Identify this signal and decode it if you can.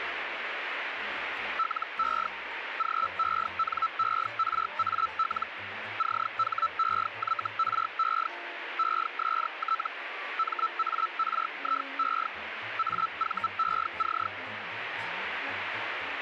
Hellschreiber (Feld-Hell, 122.5 baud), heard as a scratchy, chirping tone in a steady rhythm, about 1320 Hz, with radio static. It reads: LE GENERAL CHEYRE EST MARIE AVEC